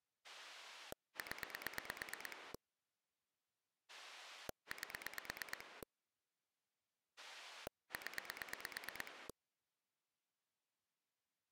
Pulse dialling, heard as a rotary dial, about 8 pulses a second. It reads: 0 8 0